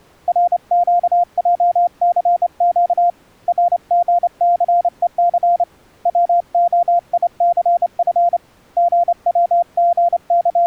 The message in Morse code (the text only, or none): RQJCQ RGCEC WOICF …